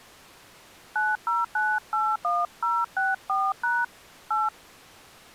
DTMF, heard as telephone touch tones, dialled by hand, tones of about 200 ms. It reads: 90981064# 8